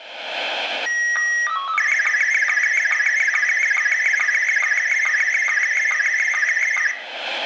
SSTV (slow-scan television), Scottie S1, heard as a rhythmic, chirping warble, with room echo.